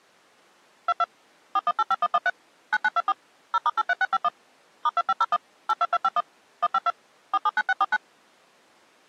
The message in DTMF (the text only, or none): 22 4185113 9924 0*83651 *2501 82251 152 479649